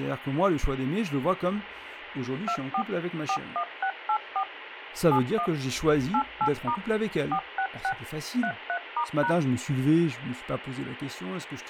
DTMF, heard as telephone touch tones, dialled by machine, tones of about 80 ms, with radio hiss and speech in French. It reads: 24 41684 71 88* 466 33*#